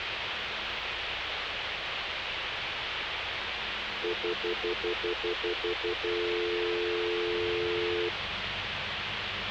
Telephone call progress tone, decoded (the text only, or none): stutter dial tone